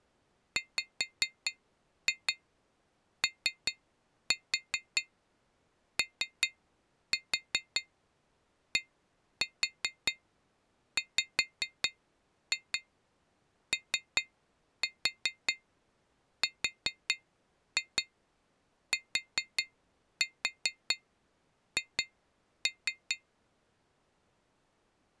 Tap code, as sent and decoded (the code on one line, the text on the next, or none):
5-2 3-4 3-4 1-4 5-2 3-4 4-2 4-4 2-3
WOODWORTH